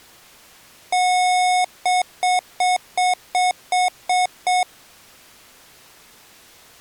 Beep code, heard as beeps from a small speaker, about 730 Hz. 1 long, 8 short. In AMI BIOS tables: display or retrace test failure.